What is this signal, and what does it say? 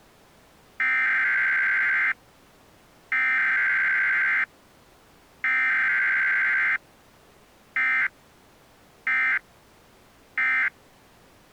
Emergency Alert System (SAME) tones (header bursts, then end-of-message bursts), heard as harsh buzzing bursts, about 520.83 baud.